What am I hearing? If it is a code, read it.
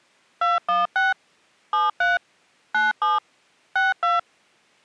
DTMF, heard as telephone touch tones, dialled by machine, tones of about 170 ms. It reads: 216 73 97 62